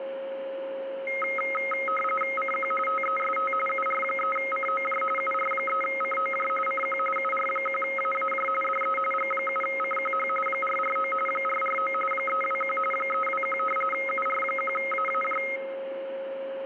RTTY (45.45 baud, 850 Hz shift), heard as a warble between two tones, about 1700 Hz centre, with a steady whistle near 540 Hz. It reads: CQ TEST UR3COJ UR3COJ CQ UR1AAJ DE G7CQH 449 449 321 321 UR1AAJ